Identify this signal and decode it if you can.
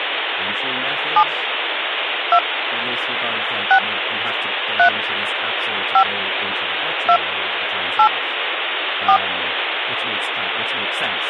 DTMF, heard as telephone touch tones, dialled by hand, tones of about 80 ms, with phone line noise and speech in English. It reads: 7 2 6 3 5 2 8 4